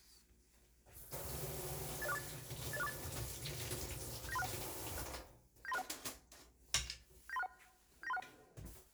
Five-tone selective call (EIA), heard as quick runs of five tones, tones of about 30 ms, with kitchen noise. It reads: 80648 80648 79361 79361 79361 79361